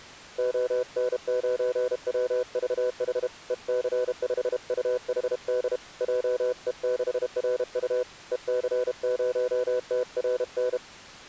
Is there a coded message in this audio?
Yes: Morse code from 0.3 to 10.8 s, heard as a keyed tone, hand-sent with a paddle, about 32 wpm, 500 Hz. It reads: ON9WVH EC5UHD JE6RU EC0TRN